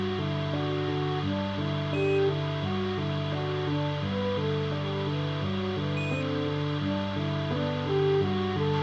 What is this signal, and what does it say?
Quindar tones, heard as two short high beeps, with radio hiss, a squelch burst at the end and room echo.